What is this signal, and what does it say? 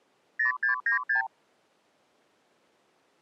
Multi-frequency trunk signalling (R2, with the far end's replies), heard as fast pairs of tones, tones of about 120 ms. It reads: 0696